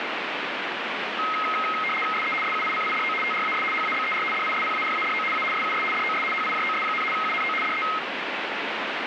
RTTY (75 baud, 850 Hz shift), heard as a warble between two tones, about 1700 Hz centre, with radio static. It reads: SE SUICIDO TRAS HABER DISPARADO A SUS DOS HIJOS, UNO DE